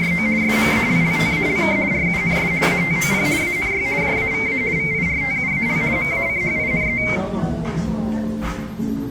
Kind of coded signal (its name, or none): RTTY